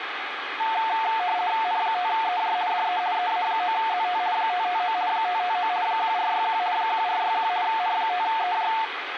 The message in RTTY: N5EJ DE EA9ZT 559 559 1461 1461 N5EJ

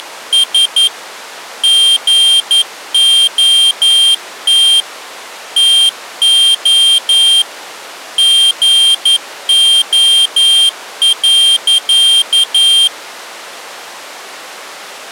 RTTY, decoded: none

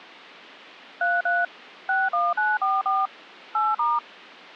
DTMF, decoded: 33 61944 8*

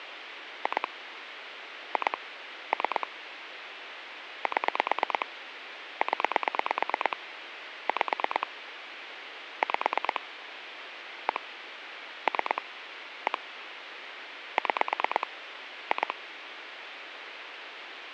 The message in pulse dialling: 2 2 3 7 0 5 5 1 3 1 6 2

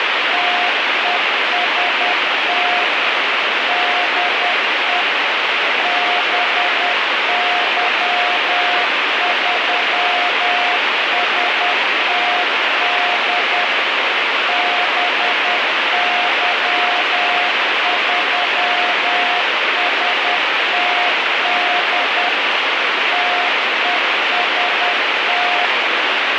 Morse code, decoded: TEST DE BY3STD BY3STD TEST

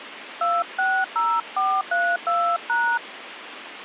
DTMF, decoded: 260432#

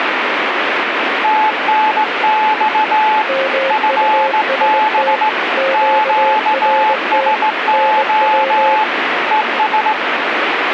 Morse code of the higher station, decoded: TNX FB QSO ES

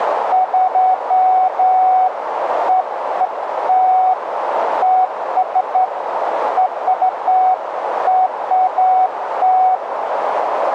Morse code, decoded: none

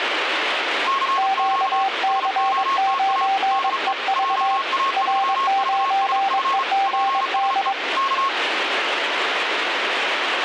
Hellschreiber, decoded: none

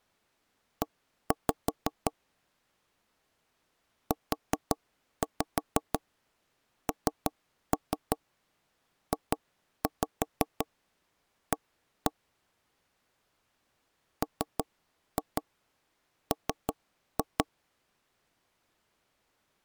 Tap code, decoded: E UNJA MM

